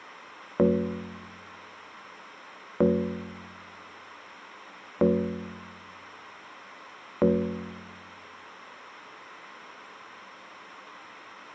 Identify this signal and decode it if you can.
Clock strike, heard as a bell. 4. Four o'clock.